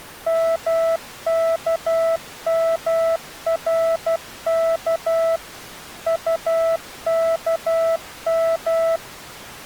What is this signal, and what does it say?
Morse code, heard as a keyed tone, machine-sent, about 12 wpm, 660 Hz. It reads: MKMRK UKM